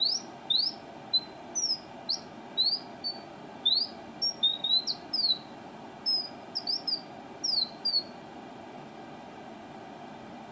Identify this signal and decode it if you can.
Bird-like chirps, with room echo. There is no code.